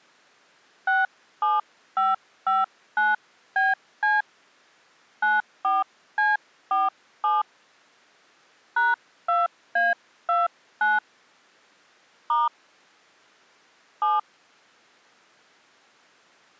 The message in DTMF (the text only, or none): 67559BC 94C47 #2A29 * 7